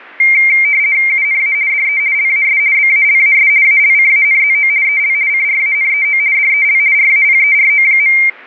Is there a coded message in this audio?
Yes: RTTY (50 baud, 170 Hz shift) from 0.2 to 8.3 s, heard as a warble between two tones, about 2200 Hz centre. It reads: UNA DE LAS BALAS ALCANZO EL CRANEO DEL RAPERO.